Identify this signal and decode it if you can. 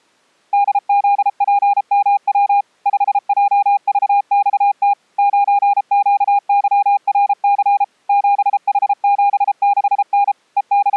Morse code, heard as a keyed tone, machine-sent, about 33 wpm, 810 Hz. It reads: DZPMW 5JVXT 9QYRC 7H76N …